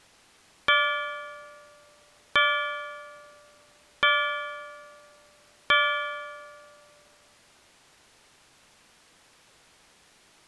Clock strike, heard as a bell. 4. Four o'clock.